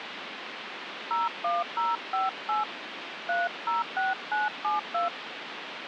DTMF, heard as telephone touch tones, dialled by hand, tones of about 160 ms, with phone line noise. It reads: 01058 306972